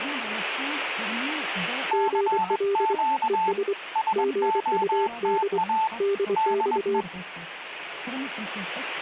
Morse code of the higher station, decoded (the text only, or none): CQ SOTA DE